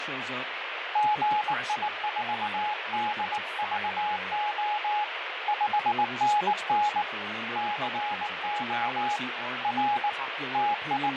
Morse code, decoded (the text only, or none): GI4DVO 5NN CO R …